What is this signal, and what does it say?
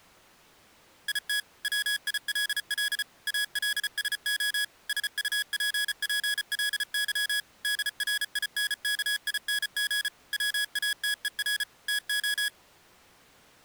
Morse code, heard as electronic beeps, machine-sent, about 34 wpm, 1650 Hz. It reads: IT WILL ALSO SUPPLY DRINKING WATER TO